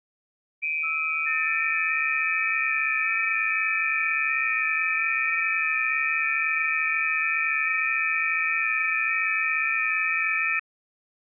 FT8 (several signals at once), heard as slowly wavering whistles, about 6.25 baud.